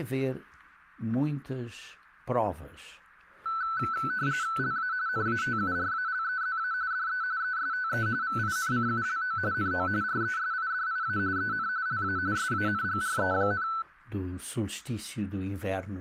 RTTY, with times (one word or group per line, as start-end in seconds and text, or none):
4.6-4.9 LA
5.1-6.7 NATURALEZA
6.9-7.2 DE
7.4-8.1 ESTE
8.2-9.4 VINCULO
9.5-9.9 NO
10.0-11.2 RESIDIA
11.4-11.7 EN
11.9-12.2 LA
12.4-13.7 SANGRE,